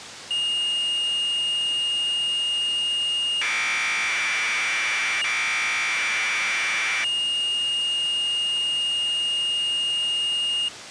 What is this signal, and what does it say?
Commodore tape loading (standard loader), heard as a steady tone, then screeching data.